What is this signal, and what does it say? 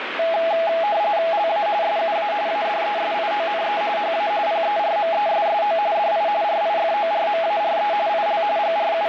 RTTY (45.45 baud, 170 Hz shift), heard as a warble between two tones, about 750 Hz centre, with radio static. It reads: LA SUA ADESIONE HA PERMESSO DI RIFORMARE IL …